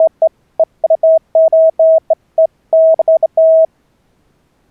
Beeps of irregular length. There is no code.